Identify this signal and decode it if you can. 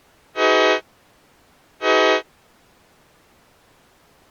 Train horn signal, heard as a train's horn. 2 short. On North American railways: a signal is acknowledged.